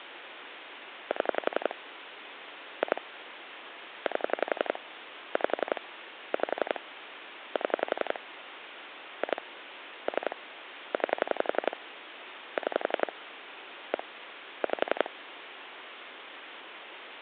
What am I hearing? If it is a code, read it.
Pulse dialling, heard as clicks on a phone line, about 11 pulses a second, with phone line noise. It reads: 7 2 8 5 5 7 2 3 9 6 1 5